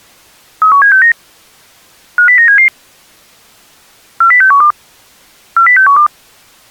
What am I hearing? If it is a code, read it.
Five-tone selective call (CCIR), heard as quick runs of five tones, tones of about 100 ms. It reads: 31769 50977 40612 40612